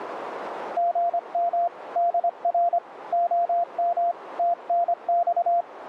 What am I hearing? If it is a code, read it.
Morse code, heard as a keyed tone, hand-sent with a paddle, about 25 wpm, 690 Hz, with radio static and a narrow filter. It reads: GM DR OM TNX